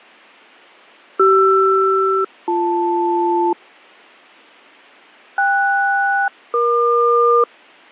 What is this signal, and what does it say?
Aircraft SELCAL, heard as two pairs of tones. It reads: CR-BL KS-EQ